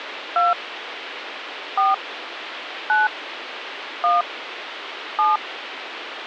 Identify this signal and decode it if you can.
DTMF, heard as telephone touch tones, dialled by hand, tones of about 170 ms, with phone line noise. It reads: 2 4 9 1 7